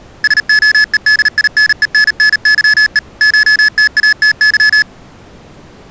Morse code (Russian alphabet), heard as electronic beeps, machine-sent, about 38 wpm, 1700 Hz. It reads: СОЕДИНЕННЫЕ ШТАТЫ